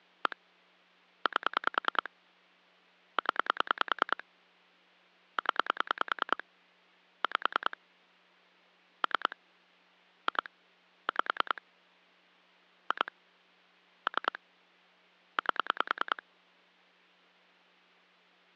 Pulse dialling, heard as clicks on a phone line, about 10 pulses a second. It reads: 1 8 0 0 5 3 2 5 2 3 8